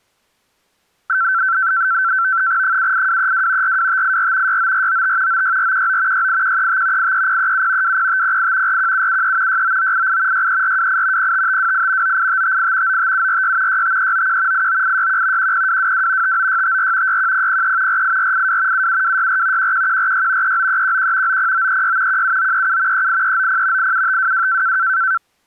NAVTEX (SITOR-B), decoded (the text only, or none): 78232 42584 69495 96419 68135 83037 20508 41773 69988 63428 05528 98558 95746 65391 89861 10222 59654 61003 48482 77264 11146 39311 90936 17937 38390 87522